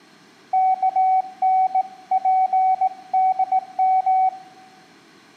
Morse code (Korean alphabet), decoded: 요즘

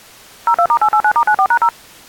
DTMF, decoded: 02*889*94#0

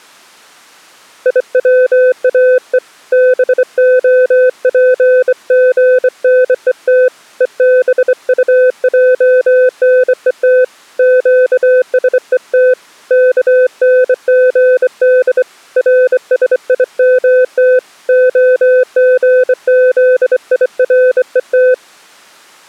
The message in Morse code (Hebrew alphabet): יצאו בהפגנות ובטענות קשות כנגד רשימת הגזירות

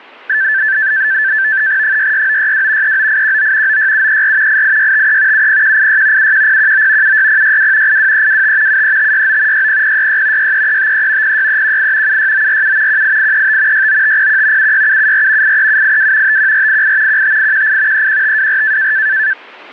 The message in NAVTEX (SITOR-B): 66962 39819 96734 88653 70186 71019 76062 82325 73569 60066 63353 06318 76947 18835 69501 76774 83782 51488 15818 31524

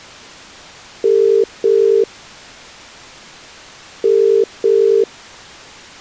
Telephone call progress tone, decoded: ringback tone

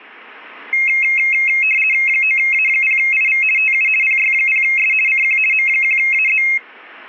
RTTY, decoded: 9A0IV TU PY0S CQ M1AZ

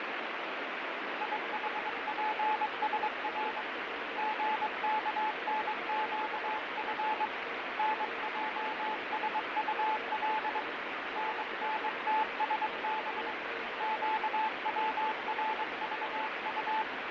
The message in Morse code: IHPSR GKNQF NJSUL NNTSB QWRVU

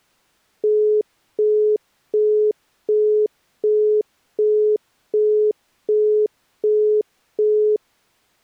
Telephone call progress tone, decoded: busy tone

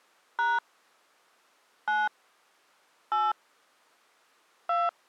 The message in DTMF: # 9 8 2

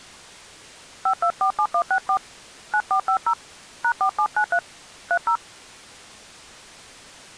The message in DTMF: 5247164 9450 #4793 30

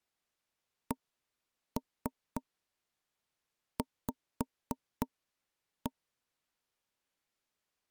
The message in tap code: CV

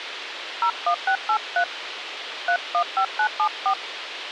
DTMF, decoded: 01683 315974

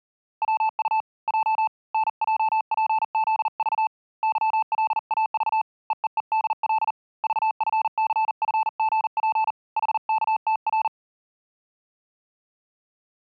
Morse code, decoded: WU J NJPZV YLAV EEEDL VFCFGP HKTR

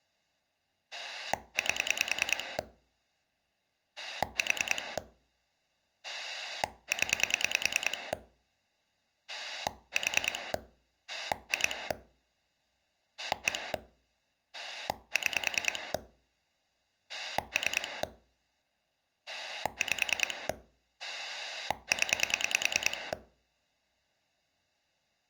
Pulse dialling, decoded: 8 4 0 4 2 1 6 3 5 0

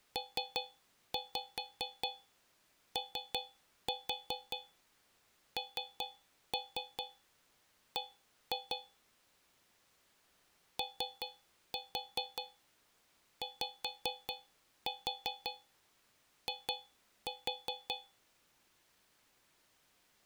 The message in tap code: PONB OYI

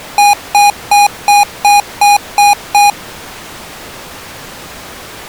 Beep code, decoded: 8 short

